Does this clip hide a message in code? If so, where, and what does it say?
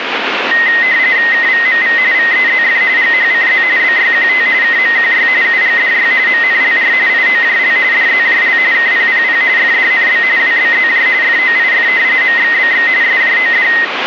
Yes: RTTY (45.45 baud, 170 Hz shift) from 0.5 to 13.8 s, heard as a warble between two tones, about 1950 Hz centre, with radio static. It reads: KVMV VEZF GHCZ BYQT KMQY UGDY MNLR IOJL DZJL KPPP FDNB WBZJ FOIF MXBX SJOD